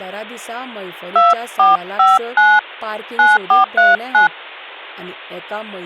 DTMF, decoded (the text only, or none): 2459 9439